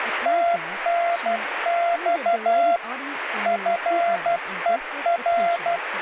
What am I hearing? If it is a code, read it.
Morse code, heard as a keyed tone, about 12 wpm, 690 Hz, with radio static and speech in English. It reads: TNX FER